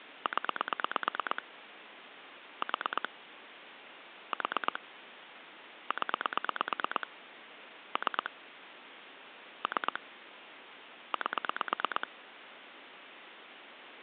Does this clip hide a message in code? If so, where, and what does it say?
Yes: pulse dialling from 0.3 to 12.0 s, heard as clicks on a phone line, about 8 pulses a second, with phone line noise. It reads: 0 4 4 0 3 3 8